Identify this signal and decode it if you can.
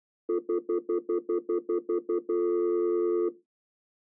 Telephone call progress tone (North American plan), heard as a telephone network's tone, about 350, 440 Hz, 0.1 s on and 0.1 s off. Stutter dial tone.